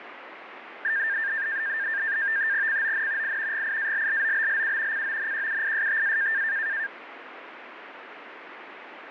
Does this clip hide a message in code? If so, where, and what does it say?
Yes: NAVTEX (SITOR-B), 100 baud, 170 Hz shift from 0.8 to 6.9 s, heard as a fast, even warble, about 1700 Hz centre, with radio static. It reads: CON I GIALLOBLU CONQUISTA